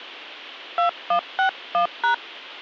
DTMF, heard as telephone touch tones, dialled by hand, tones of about 100 ms. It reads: 2161#